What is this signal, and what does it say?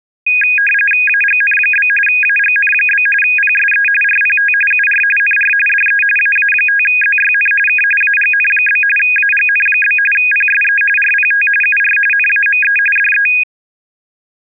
RTTY (45.45 baud, 850 Hz shift), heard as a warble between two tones, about 2050 Hz centre. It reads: AGN? AGN? PSE RPT UR NR DE AA5ZYN K AGN? AGN? PSE RPT UR NAME DE